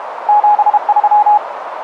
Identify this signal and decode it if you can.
Morse code, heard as a keyed tone, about 32 wpm, 840 Hz, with radio static and a narrow filter. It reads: 73